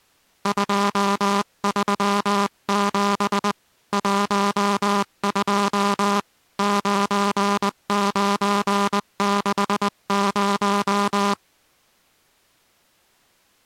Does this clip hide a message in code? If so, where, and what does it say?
Yes: Morse code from 0.4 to 11.4 s, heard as a buzzer, hand-sent with a paddle, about 20 wpm. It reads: 237 12 9960